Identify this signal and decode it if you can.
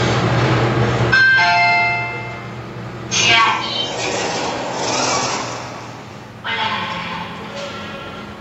The noise inside a lift. There is no code.